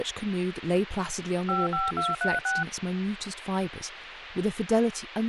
DTMF, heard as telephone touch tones, dialled by machine, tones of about 180 ms, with radio hiss and speech in English. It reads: 55236